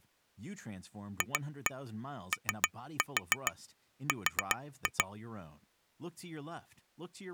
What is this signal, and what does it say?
Tap code, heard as taps on glass, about 7 knocks a second, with speech in English. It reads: FOR